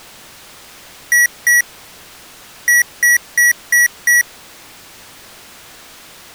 Beep code, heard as beeps from a small speaker, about 1950 Hz. 2-5.